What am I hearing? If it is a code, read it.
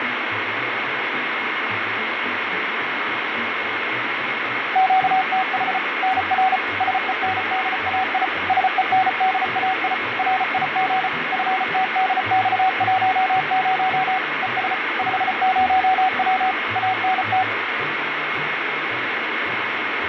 Morse code, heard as a keyed tone, machine-sent, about 34 wpm, 750 Hz, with radio static, fading and a steady whistle near 2160 Hz. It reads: QTH NR SENDAI SENDAI RIG FTDX10 ES 50W ANT